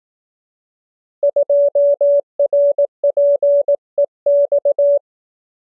Morse code, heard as a keyed tone, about 18 wpm, 570 Hz. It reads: 2RPEX